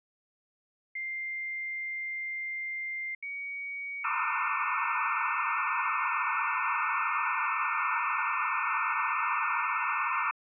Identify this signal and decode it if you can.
Dial-up modem handshake (low-speed, two carriers), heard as two whistles, then hiss.